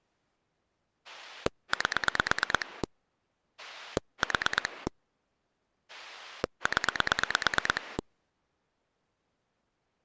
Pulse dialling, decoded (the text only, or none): 8 4 0